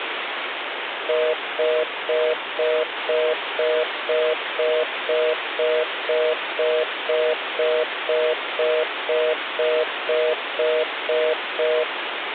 Telephone call progress tone (North American plan), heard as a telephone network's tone, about 480, 620 Hz, 0.25 s on and 0.25 s off, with phone line noise. Congestion tone.